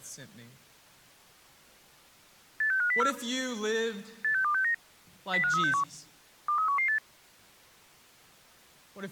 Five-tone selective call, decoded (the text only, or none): 86504 86269 05361 23118